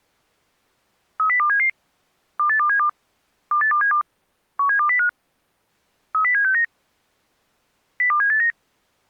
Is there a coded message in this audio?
Yes: five-tone selective call (CCIR) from 1.2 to 8.5 s, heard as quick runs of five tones, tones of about 100 ms. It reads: 30277 28272 28272 17205 30769 02789